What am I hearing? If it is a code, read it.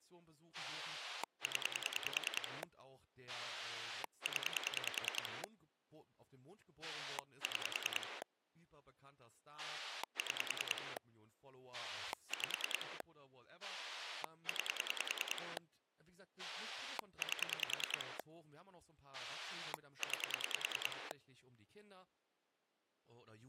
Pulse dialling, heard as a rotary dial, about 10 pulses a second, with speech in German. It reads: 0 0 6 6 5 9 8 9